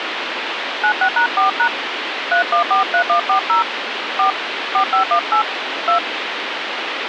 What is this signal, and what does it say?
DTMF, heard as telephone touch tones, dialled by hand, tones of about 100 ms, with phone line noise. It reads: 96#4# 3143140 4 4518 2